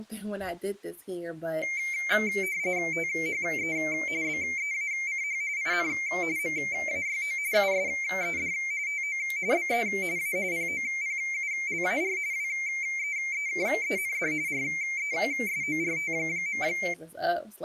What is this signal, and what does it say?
RTTY (45.45 baud, 170 Hz shift), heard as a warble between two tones, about 2200 Hz centre, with speech in English. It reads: THE BEACH IN MAYO USED TO BE A POPULAR WEEKEND RESORT.